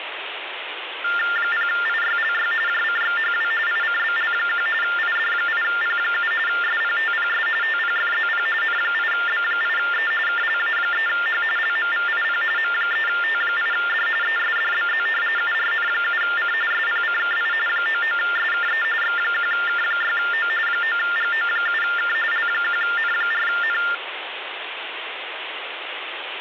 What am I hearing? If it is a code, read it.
TTY/TDD text telephone tones (45.45 baud Baudot), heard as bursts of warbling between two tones, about 400 Hz shift, 1600 Hz centre, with phone line noise. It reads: 0IYLY JCXHW ICBL1 ID8P7 SPTPS TPFZP N8B8E KLA3H LMVIP M3T8D ESDBZ URN7C SPCKI 99SKE X1K6O 9GO7K L1N4N